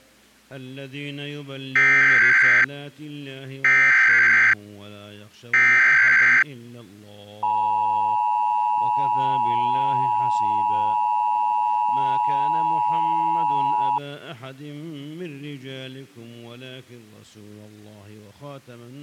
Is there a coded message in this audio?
Yes: Emergency Alert System (SAME) tones (header bursts, then the 853 and 960 Hz attention tone) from 1.8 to 14.0 s, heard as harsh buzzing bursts, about 520.83 baud.